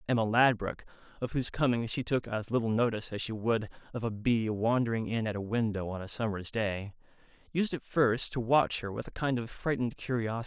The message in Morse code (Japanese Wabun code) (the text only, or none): none